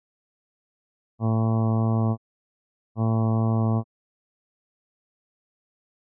Ship horn signal, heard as a ship's horn, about 110 Hz. 2 short. At sea: I am altering course to port.